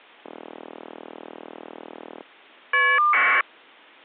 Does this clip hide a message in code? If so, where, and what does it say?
Yes: caller ID data burst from 0.2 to 3.4 s, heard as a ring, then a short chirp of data, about 1200 baud.